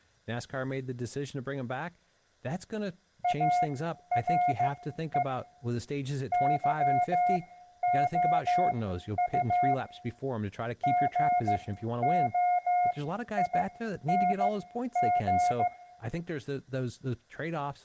Morse code, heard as a keyed tone, machine-sent, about 15 wpm, spaced as for 11 wpm, 720 Hz, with room echo and speech in English. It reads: ARE YOU GOING